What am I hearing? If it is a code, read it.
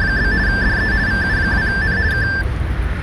RTTY (50 baud, 170 Hz shift), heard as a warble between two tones, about 1650 Hz centre, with radio static and street noise. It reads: … DE VU2N K